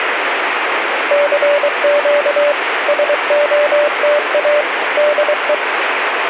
Morse code, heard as a keyed tone, machine-sent, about 23 wpm, 590 Hz, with radio static. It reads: CQ SOTA DE